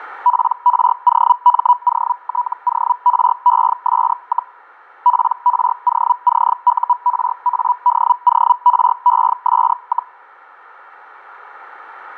Hellschreiber (Feld-Hell, 122.5 baud), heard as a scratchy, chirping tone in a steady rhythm, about 980 Hz. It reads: PROMOTORES, PROCURADORES,